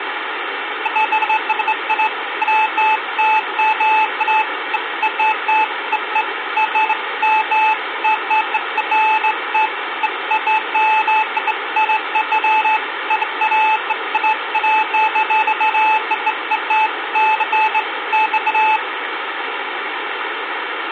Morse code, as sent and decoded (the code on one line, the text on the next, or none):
none